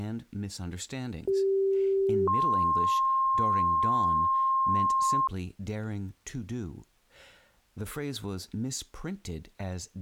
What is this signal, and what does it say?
Two-tone page, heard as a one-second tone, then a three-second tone, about 390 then 1060 Hz, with speech in English.